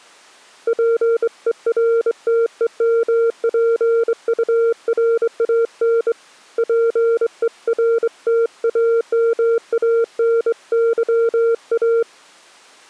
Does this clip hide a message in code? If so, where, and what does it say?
Yes: Morse code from 0.6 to 12.1 s, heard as a keyed tone, hand-sent with a straight key, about 24 wpm, 460 Hz. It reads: PERTEMPURAN PERTAMANYA